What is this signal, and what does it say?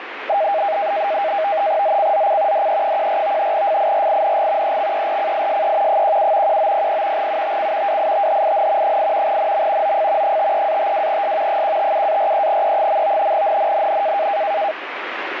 NAVTEX (SITOR-B), 100 baud, 170 Hz shift, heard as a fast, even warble, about 720 Hz centre, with radio static. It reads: ZCZC DE14 FIRING EXERCISE 17 1900 UTC WITHIN 8 NM OF 53-52S 157-43E. NNNN